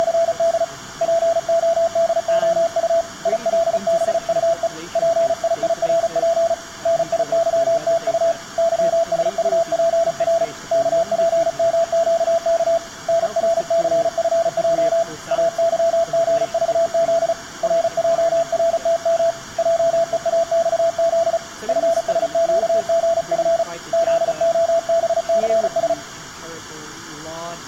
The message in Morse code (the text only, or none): … PODOU ILBUE PIIRP NIYTU YSUPR KPMQK NRCFJ AYGVZ RJRTM JEAXZ FSQGF ZOBCS